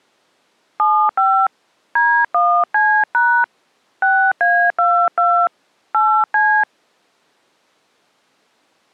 DTMF, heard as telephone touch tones, dialled by hand, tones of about 290 ms. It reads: 75 D1C# 6A22 8C